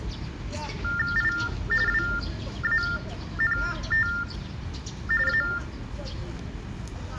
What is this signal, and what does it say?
TTY/TDD text telephone tones (45.45 baud Baudot), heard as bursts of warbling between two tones, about 400 Hz shift, 1600 Hz centre, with the noise of a park. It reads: I WANT A